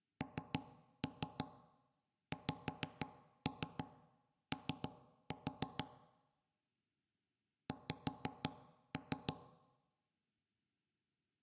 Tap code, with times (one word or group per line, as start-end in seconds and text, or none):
0.2-5.8 NXO
7.7-9.3 X